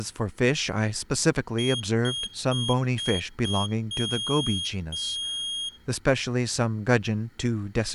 Beep code, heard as a piezo beeper, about 3250 Hz, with room echo and speech in English. 5 short, 2 long.